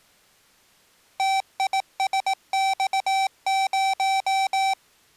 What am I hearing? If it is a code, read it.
Morse code, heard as electronic beeps, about 18 wpm, 770 Hz. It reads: TISX0